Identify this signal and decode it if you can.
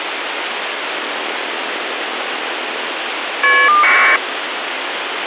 Caller ID data burst, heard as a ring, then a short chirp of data, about 1200 baud, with phone line noise.